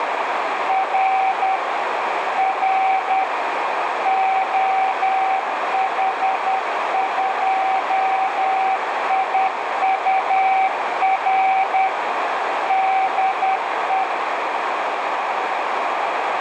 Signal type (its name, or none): Morse code